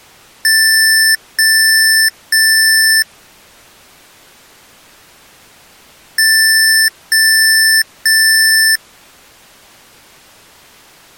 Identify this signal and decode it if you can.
Beep code, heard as beeps from a small speaker, played twice, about 1750 Hz. 3 long. In IBM BIOS tables: keyboard card error.